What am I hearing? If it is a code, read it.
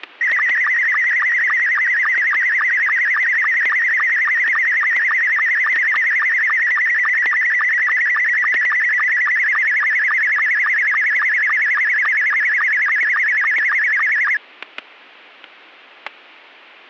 SSTV (slow-scan television), Scottie S2, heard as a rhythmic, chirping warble, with static crashes.